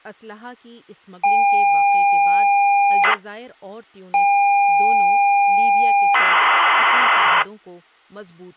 ZX Spectrum tape loading, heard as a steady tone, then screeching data, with speech in Urdu.